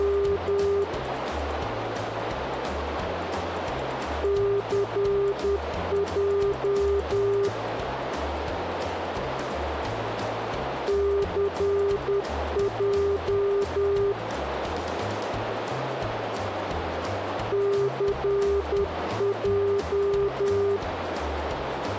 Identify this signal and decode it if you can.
Morse code, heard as a keyed tone, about 10 wpm, 400 Hz, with radio static and a narrow filter. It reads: … CJ CJ CJ